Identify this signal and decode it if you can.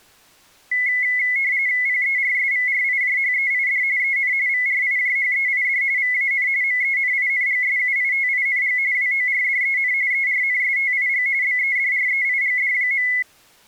RTTY (45.45 baud, 170 Hz shift), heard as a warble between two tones, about 2100 Hz centre. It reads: PERSVRIJHEID EN VRIJHEID VAN MENINGSUITING WORDEN ERNSTIG BEDREIGD.